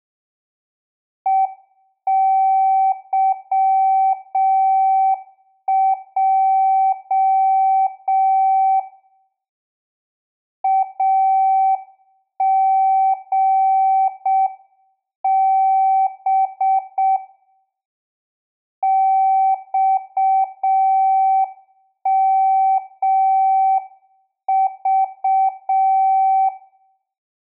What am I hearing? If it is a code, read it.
Morse code, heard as a keyed tone, hand-sent with a straight key, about 6 wpm, 770 Hz, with room echo. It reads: EYJ AGB XMV